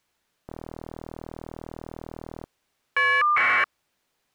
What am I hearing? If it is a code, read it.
Caller ID data burst, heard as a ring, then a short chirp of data, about 1200 baud.